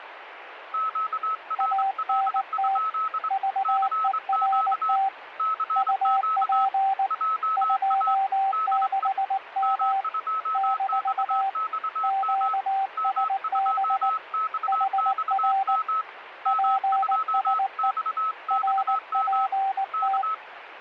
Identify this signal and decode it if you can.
Morse code, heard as two keyed tones, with radio static. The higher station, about 24 wpm, 1290 Hz: QRL? CQ CQ JA DE M2XXM M2XXM M2XXM K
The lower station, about 19 wpm, 780 Hz: ANT VERT UP 26M - QSB HR PSE RPT